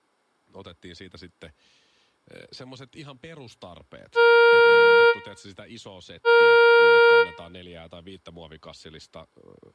Ship horn signal, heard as a ship's horn, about 470 Hz, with room echo and speech in Finnish. 2 short. At sea: I am altering course to port.